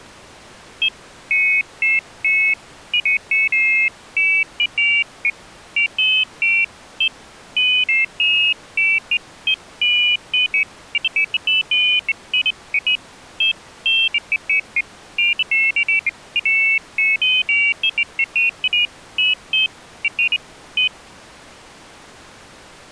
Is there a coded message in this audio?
No, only pairs of high tones at irregular times.